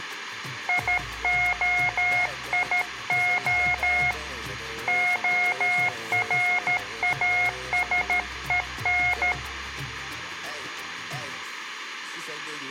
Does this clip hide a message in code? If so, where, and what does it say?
Yes: Morse code (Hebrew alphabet) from 0.6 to 9.4 s, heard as a keyed tone, hand-sent with a paddle, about 13 wpm, 720 Hz, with room echo. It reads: יהיה הראשון